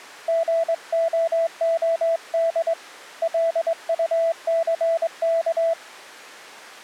Morse code, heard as a keyed tone, hand-sent with a straight key, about 22 wpm, 660 Hz. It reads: GOOD LUCK